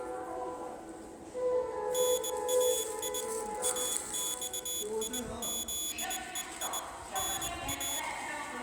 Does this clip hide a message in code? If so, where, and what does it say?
Yes: Morse code (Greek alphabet) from 1.9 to 8.1 s, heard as a high beeper, hand-sent with a bug key, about 20 wpm, 3400 Hz, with room echo and the noise of a subway station. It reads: ΝΑΙ ΑΞΙΖΕΙ ΝΑ